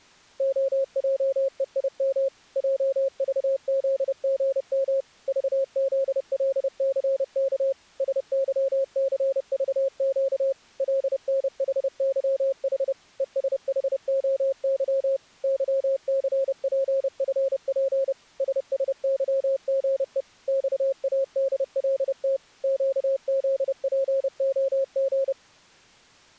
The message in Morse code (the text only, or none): OJEIM JVZGM VZLCK SYCVQ LNHYH ESHOY YCPFP SSYGE XADLT QZPOG